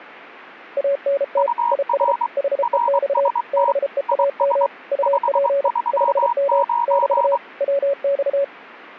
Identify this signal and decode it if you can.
Morse code, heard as two keyed tones. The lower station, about 33 wpm, 560 Hz: ANT IS HEX BEAM UP 5M <BT> WX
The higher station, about 23 wpm, 950 Hz: UR RST IS 539